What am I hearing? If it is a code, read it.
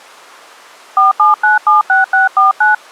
DTMF, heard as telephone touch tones, dialled by hand, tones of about 150 ms. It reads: 47976649